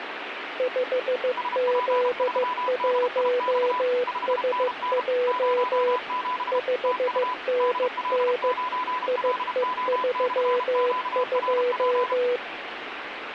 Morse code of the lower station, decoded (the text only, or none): 5Z1SJ 5NN IE32